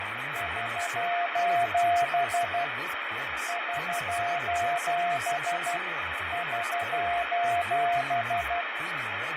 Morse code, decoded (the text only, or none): <SOS> <SOS> <SOS>